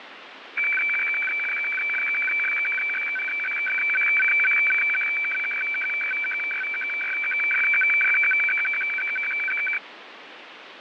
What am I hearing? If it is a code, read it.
Weather fax (radiofax), 120 lines a minute, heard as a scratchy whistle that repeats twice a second, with radio static.